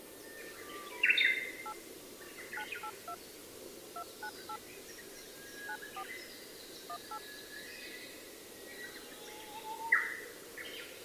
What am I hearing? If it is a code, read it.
DTMF, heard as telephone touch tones, dialled by hand, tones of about 70 ms. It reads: 8 982 298 94 18